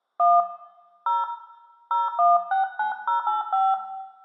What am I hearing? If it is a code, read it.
DTMF, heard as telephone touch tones, dialled by hand, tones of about 170 ms, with room echo. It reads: 1 0 0169085